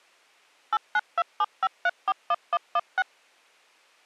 DTMF, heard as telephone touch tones, dialled by machine, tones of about 40 ms. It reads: 89275341116